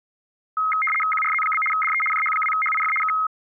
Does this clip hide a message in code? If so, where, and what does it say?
Yes: RTTY (75 baud, 850 Hz shift) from 0.6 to 3.3 s, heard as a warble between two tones, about 1700 Hz centre. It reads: QRZ? DE JH2HIF K